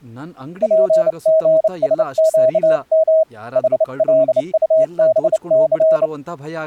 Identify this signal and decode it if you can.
Morse code, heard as a keyed tone, hand-sent with a bug key, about 29 wpm, 640 Hz, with speech in Kannada. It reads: PGSQM HLUBC